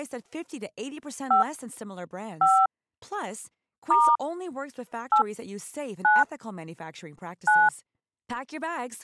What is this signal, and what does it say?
DTMF, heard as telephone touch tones, dialled by hand, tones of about 180 ms, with speech in Spanish. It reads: 5 5 * 8 9 9